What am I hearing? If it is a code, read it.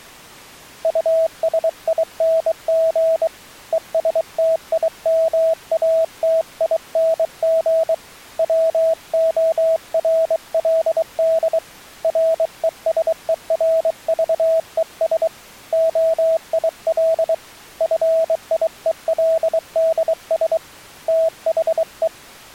Morse code, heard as a keyed tone, hand-sent with a bug key, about 23 wpm, 650 Hz. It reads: USING ESTIMATING WORLD RESERVES OIL FIELDS THE